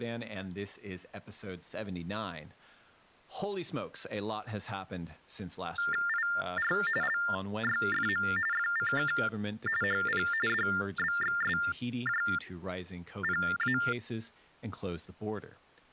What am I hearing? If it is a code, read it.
TTY/TDD text telephone tones (45.45 baud Baudot), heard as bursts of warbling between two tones, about 400 Hz shift, 1600 Hz centre, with speech in English. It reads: IR LYFM FCK HP DBXSJPA